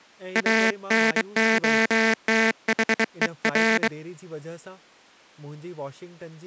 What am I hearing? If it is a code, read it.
Morse code, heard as a buzzer, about 23 wpm, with speech in Sindhi. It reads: ANOTHER